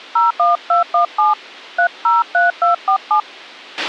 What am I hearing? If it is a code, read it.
DTMF, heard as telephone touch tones, dialled by hand, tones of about 140 ms, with a squelch burst at the end. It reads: 01217 303247